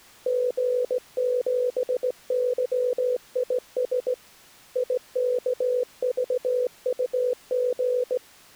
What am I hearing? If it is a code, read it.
Morse code, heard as a keyed tone, hand-sent with a straight key, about 17 wpm, 500 Hz. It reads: G7YIS IKVUG